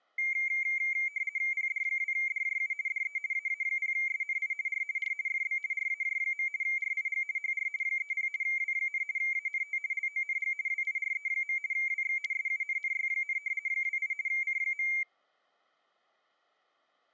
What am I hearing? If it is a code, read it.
RTTY (50 baud, 170 Hz shift), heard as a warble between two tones, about 2200 Hz centre. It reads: PD2DJU DE AA0SNI R R FB RAJ. RIG HR 30 W, ANT LONG WIRE. WX SUNNY, 28 C.